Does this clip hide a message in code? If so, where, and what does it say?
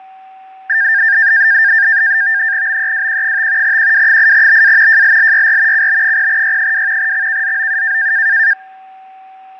Yes: NAVTEX (SITOR-B), 100 baud, 170 Hz shift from 0.7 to 8.5 s, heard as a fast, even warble, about 1700 Hz centre, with fading and a steady whistle near 760 Hz. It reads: BEWQ5 QW8BA JLLYR CB0Y2 XKZOU